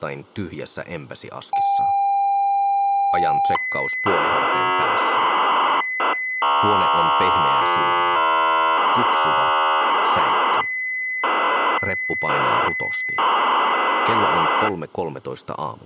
ZX Spectrum tape loading, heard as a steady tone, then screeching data.